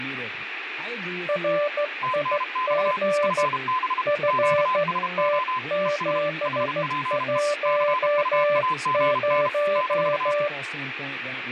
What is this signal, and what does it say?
Morse code, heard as two keyed tones, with room echo and speech in English. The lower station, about 14 wpm, 590 Hz: RIG FT710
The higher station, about 32 wpm, 1020 Hz: TNX FB QSO ES HPE CUAGN -